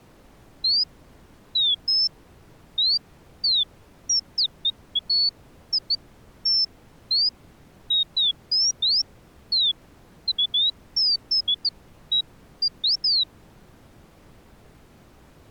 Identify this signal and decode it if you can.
Bird-like chirps. There is no code.